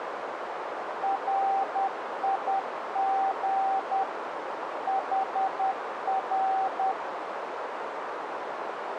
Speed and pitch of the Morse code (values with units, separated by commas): 10 wpm, 780 Hz